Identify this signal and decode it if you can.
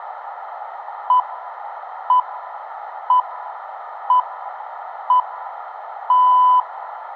Radio time signal (six pips, as the Greenwich Time Signal), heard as pips, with room echo.